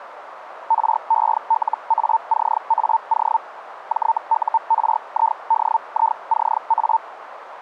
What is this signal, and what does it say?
Hellschreiber (Feld-Hell, 122.5 baud), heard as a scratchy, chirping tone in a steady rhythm, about 900 Hz, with radio static. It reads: RELACAO JURIDICA